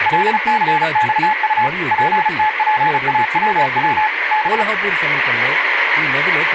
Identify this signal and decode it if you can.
Morse code, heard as a keyed tone, machine-sent, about 35 wpm, 860 Hz, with radio static, room echo and speech in Telugu. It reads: LCXU PTPAWW B